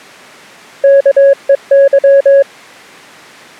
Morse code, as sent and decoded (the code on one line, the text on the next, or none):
-.- . -.--
KEY